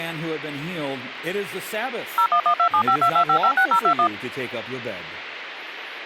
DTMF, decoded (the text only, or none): 01127522556021